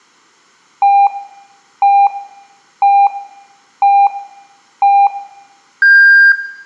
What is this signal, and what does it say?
Radio time signal (five pips and a higher one, as on Chinese radio), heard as pips.